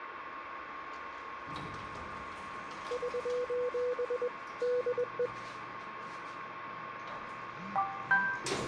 Morse code, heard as a keyed tone, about 21 wpm, 490 Hz, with radio static and the noise inside a lift. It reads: <SOS> DE